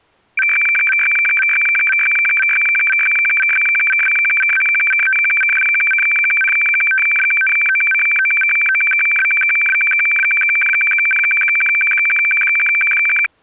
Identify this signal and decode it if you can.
Weather fax (radiofax), 120 lines a minute, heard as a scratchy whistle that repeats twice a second.